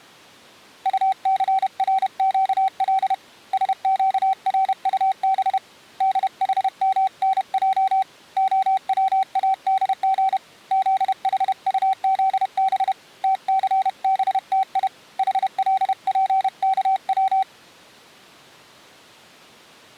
Morse code (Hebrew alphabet), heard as a keyed tone, hand-sent with a paddle, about 31 wpm, 770 Hz. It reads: טסרקל שקרטב דחמנע הצאדג זחטזב תסבתי חלפכץ